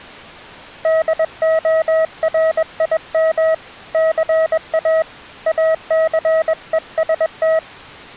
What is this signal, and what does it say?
Morse code, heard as a keyed tone, hand-sent with a paddle, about 21 wpm, 640 Hz. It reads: DORIM CA ACEST